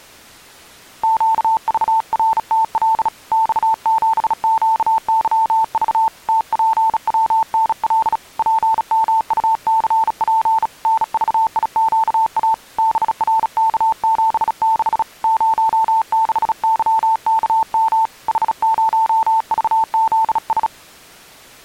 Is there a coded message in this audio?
Yes: Morse code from 1.0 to 20.7 s, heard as a keyed tone, hand-sent with a bug key, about 36 wpm, 890 Hz. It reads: QVRTL X7QYV TPWNL PMUCP NVIQA BRK76 06YKM H0VZS